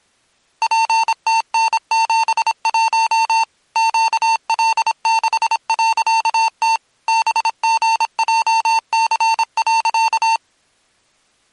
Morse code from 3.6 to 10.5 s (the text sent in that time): QL6.T BGJC.